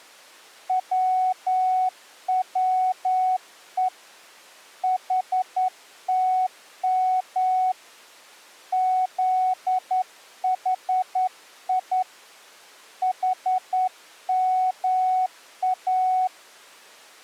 Morse code, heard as a keyed tone, hand-sent with a straight key, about 10 wpm, 740 Hz. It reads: WWE HTM ZHI HMA